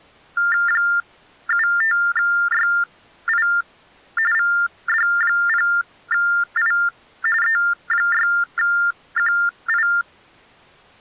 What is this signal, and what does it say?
TTY/TDD text telephone tones (45.45 baud Baudot), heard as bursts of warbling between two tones, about 400 Hz shift, 1600 Hz centre. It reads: 75YI VD0I E6QI